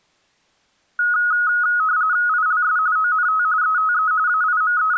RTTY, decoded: ILS ONT ETE …

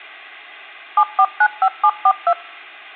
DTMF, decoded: 7495742

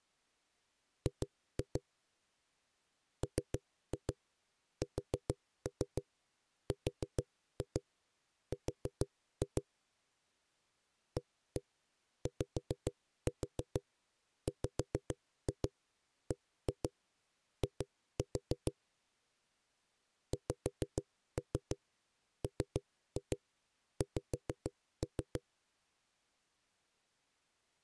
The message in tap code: G MSRR AYWBI XMX

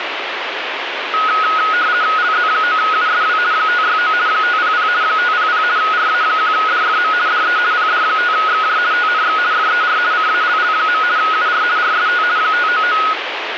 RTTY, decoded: LZ9USW 569 500 500 RA1DFM DE PD5XJ TNX FER CALL. UR RST 599

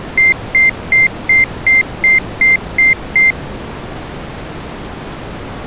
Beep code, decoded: 9 short

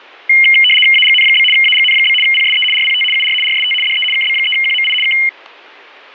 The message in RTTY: AGN? AGN? PSE RPT UR RST DE KB3QMI K

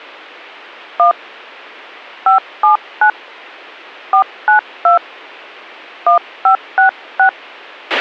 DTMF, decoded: 1 579 492 1566

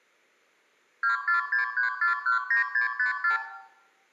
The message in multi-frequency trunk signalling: 2463419654

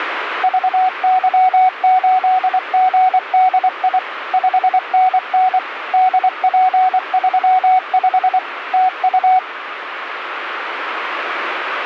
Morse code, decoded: VY8GDI 5NN DP35 TU

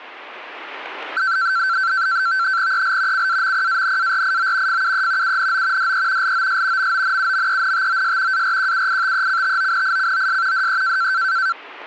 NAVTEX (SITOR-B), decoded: EL CAMPANARIO FUE UNO DE LOS MONUMENTOS ARQUITECTONICOS DE

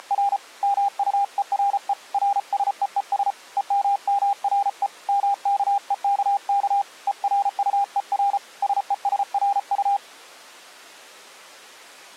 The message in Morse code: … MUERE RSEES EMMRE MKEKK ERUER SESRU

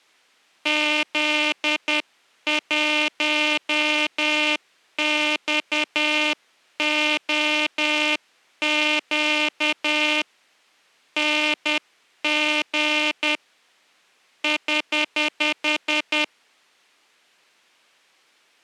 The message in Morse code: Z1XOQ NG <HH>

